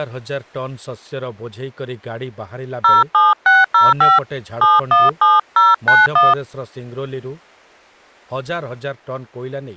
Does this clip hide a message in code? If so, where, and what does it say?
Yes: DTMF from 2.8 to 6.3 s, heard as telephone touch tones, dialled by hand, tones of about 180 ms, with speech in Odia. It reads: 07605 717091